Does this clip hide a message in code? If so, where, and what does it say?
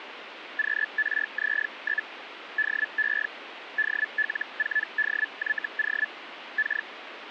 Yes: Hellschreiber (Feld-Hell, 122.5 baud) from 0.6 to 6.9 s, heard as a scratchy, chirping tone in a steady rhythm, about 1750 Hz, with radio static. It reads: QRZ? DE DL4DYO K